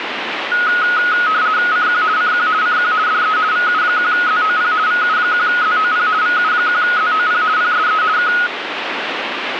RTTY (50 baud, 170 Hz shift), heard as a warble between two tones, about 1360 Hz centre, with radio static. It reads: CQ CQ CQ DE VU1ZOP VU1ZOP VU1ZOP PSE K